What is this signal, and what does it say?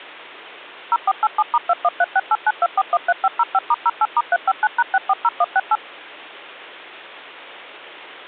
DTMF, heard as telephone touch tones, dialled by machine, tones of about 40 ms, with hum. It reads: 0487*2136892413505*08*359#640168